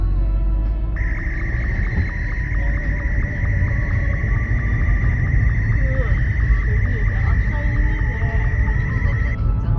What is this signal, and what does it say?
SSTV (slow-scan television), Martin M2, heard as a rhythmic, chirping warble, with the noise inside a car.